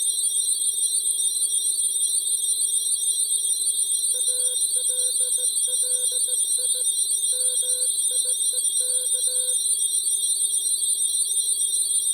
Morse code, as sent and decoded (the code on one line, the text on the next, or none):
.- .-.. .-.. .. / -- .. . -.-
ALLI MIEK